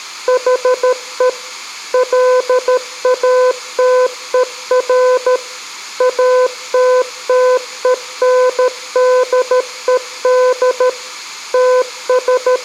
Morse code, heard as a keyed tone, machine-sent, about 13 wpm, 500 Hz, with room echo. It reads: HE LATER ATTENDED …